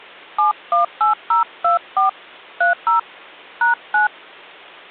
DTMF, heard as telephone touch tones, dialled by hand, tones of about 130 ms. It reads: 718024 30 #9